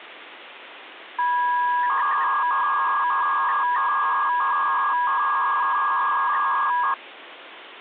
300-baud modem data (V.21 tones), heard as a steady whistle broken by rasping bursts, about 300 baud, 200 Hz shift, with phone line noise.